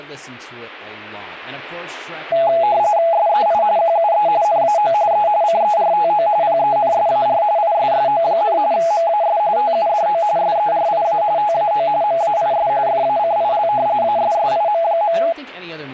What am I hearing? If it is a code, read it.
RTTY (45.45 baud, 170 Hz shift), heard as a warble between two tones, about 750 Hz centre, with speech in English. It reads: SEI QUE NAO E CERTO PENSAR ISSO, MAS TUDO SERIA TAO MAIS FACIL ASSIM.